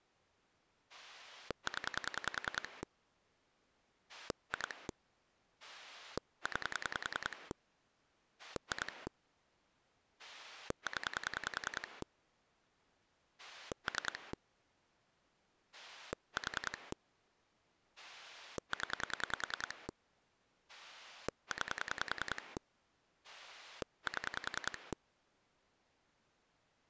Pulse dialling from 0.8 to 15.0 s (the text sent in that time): 0 2 9 2 0 3